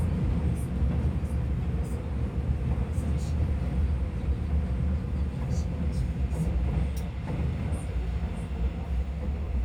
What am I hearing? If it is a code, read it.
The noise inside a subway train. There is no code.